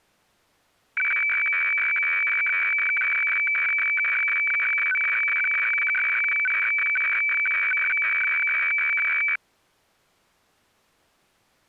Weather fax (radiofax), 120 lines a minute, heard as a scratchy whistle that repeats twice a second.